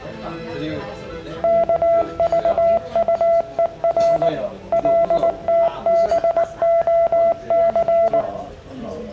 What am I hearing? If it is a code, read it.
Morse code, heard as a keyed tone, machine-sent, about 19 wpm, 670 Hz, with room echo and the noise of a crowd indoors. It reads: KVUER LTBOC